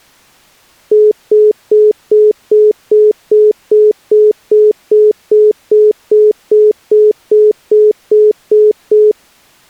Telephone call progress tone (single-tone plan, as in most of Europe), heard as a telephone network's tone, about 420 Hz, 0.2 s on and 0.2 s off. Congestion tone.